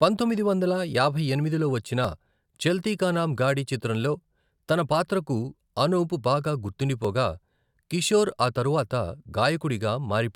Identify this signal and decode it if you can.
Speech in Telugu. There is no code.